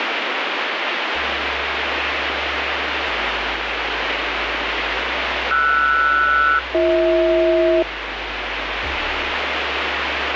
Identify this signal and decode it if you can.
Aircraft SELCAL, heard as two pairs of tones, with radio static. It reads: RS-BH